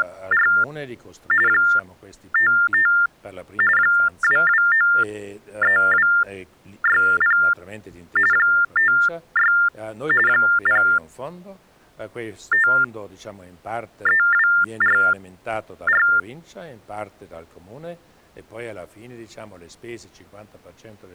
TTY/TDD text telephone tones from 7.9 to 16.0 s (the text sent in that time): 56 053244